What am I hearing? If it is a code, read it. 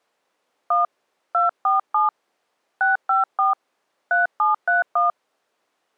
DTMF, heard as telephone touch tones, dialled by hand, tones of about 150 ms. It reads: 1 247 654 3731